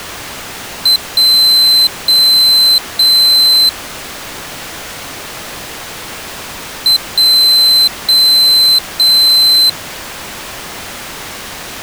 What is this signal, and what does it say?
Beep code, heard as a piezo beeper, played twice, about 4050 Hz. 1 short, 3 long.